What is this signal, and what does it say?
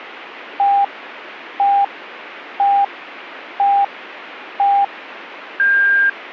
Radio time signal (five pips and a higher one, as on Chinese radio), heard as pips.